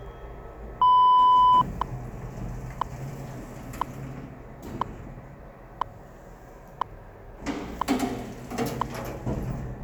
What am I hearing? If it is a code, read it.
Radio time signal (WWV, Colorado), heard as ticks, one a second, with the noise inside a lift.